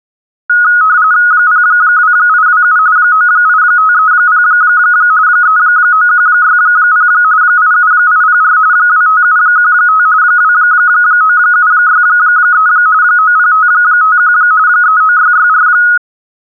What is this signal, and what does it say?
RTTY (45.45 baud, 170 Hz shift), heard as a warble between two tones, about 1360 Hz centre. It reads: 02827 98530 39160 87804 25715 29763 90551 39664